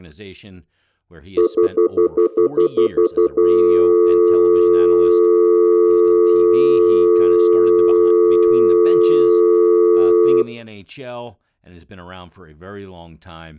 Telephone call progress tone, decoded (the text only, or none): stutter dial tone